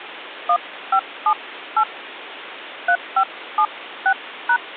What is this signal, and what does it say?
DTMF, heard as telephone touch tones, dialled by hand, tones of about 70 ms, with phone line noise. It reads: 1578 3576#